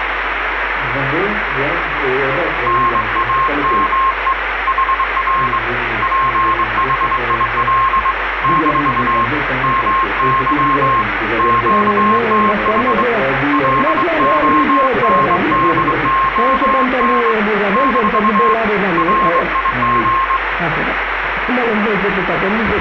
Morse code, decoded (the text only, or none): NAME HR PHIL - MY QTH LONDON - RIG